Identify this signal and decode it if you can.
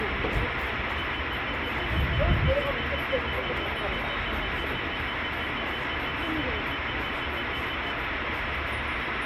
Evenly repeated beeps, with radio static and street noise. There is no code.